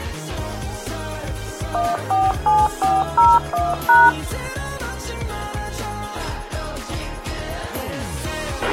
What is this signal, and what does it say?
DTMF, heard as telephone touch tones, dialled by machine, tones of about 200 ms, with a squelch burst at the end. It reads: 147401#